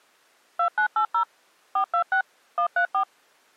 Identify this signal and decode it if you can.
DTMF, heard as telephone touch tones, dialled by machine, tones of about 90 ms. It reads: 2980 426 134